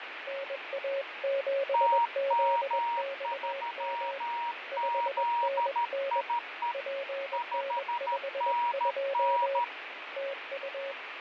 Morse code, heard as two keyed tones, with radio static and fading. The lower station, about 21 wpm, 550 Hz: NA7ZXM 5NN PN52 TU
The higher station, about 13 wpm, 950 Hz: TM3ZIE 5NN